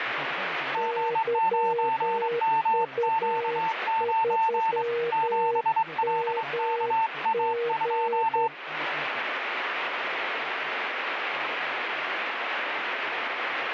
Morse code, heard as two keyed tones, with radio static. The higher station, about 23 wpm, 900 Hz: G9MQ9 7LKA2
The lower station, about 10 wpm, 470 Hz: YU3MG